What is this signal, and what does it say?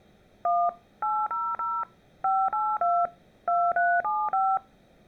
DTMF, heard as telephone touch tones, dialled by machine, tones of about 240 ms. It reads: 1 800 582 2375